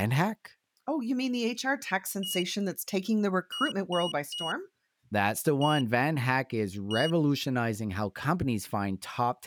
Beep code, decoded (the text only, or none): 1-3-1-1